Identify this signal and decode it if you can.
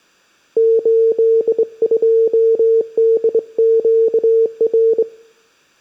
Morse code, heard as a keyed tone, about 23 wpm, 450 Hz. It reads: 82DQR